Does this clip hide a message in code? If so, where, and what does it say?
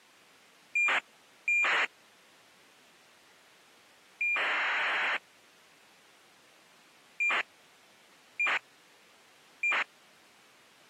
Yes: ACARS aircraft data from 0.8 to 9.8 s, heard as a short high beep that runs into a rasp, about 2400 baud.